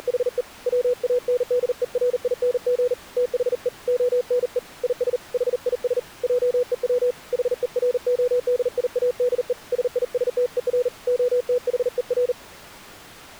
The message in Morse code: … WANDERING THE ONE IS HIS JEW HERODIADE SISTER OTHER

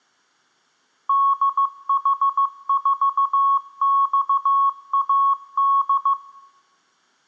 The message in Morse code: DH4XAD

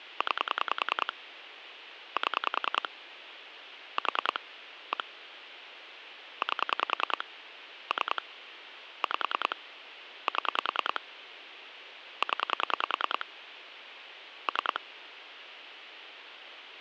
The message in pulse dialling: 9 7 4 1 8 3 5 7 0 3

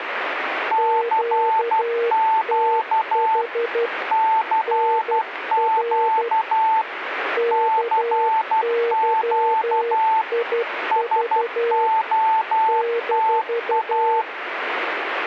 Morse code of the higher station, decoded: CQ CQ CQ SOTA

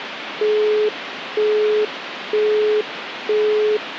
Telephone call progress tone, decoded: busy tone

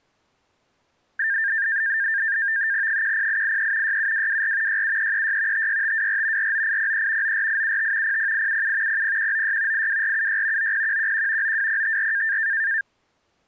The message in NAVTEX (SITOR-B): 10883 67224 67336 56524 49803 94875 00877 00196 82476 90111 92054

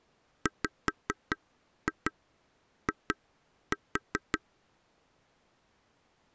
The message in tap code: WI

